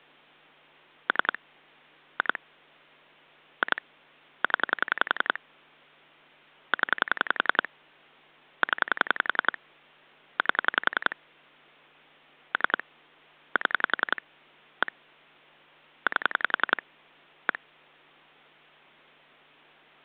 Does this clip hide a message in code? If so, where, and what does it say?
Yes: pulse dialling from 1.1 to 17.6 s, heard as clicks on a phone line, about 11 pulses a second. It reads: 3 2 2 0 0 0 8 3 7 1 8 1